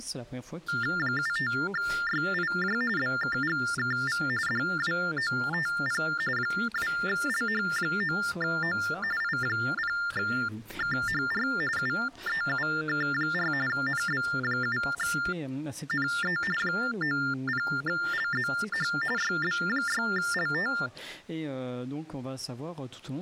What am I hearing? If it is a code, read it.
TTY/TDD text telephone tones (45.45 baud Baudot), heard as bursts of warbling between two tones, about 400 Hz shift, 1600 Hz centre. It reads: 75YIJ BKGKV DWOTP 2LH9O I0KHR UEUK4 NB7NE 90LZH YB6LT